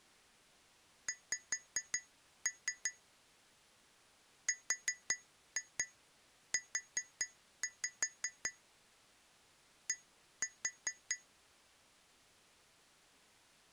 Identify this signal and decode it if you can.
Tap code, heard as taps on glass, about 5 knocks a second. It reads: X RU D